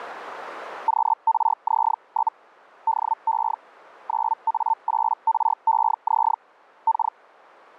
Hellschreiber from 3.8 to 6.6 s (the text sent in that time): 9A8REZ